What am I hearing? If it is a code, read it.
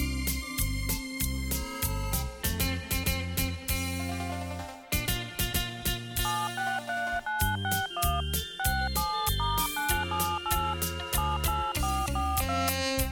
DTMF, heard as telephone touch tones, dialled by hand, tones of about 260 ms. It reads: 763961 67*978 78442